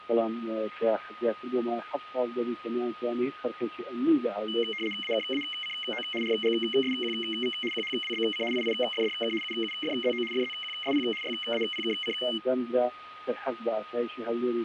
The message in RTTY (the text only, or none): AKACO RGSQV QHWBC IIFDK UUFZO FZQSP YAPKC